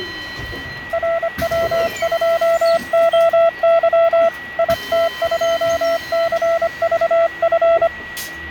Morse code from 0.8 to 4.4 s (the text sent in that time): RW2OY